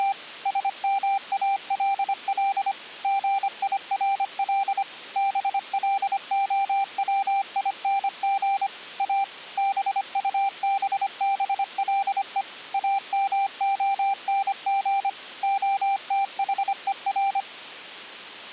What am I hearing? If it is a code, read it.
Morse code, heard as a keyed tone, machine-sent, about 25 wpm, 790 Hz. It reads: … SMALL GIRL BLOWING A BUBBLE AMONG OTHER